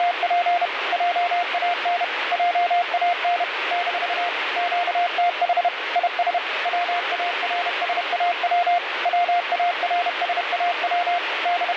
Morse code, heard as a keyed tone, machine-sent, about 31 wpm, 700 Hz, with radio static. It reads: … JAN JAN - QTH IS WARSAW WARSAW …